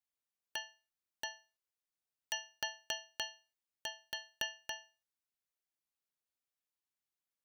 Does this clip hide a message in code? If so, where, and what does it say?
Yes: tap code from 0.6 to 5.0 s, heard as taps on a metal pipe, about 4 knocks a second. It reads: AT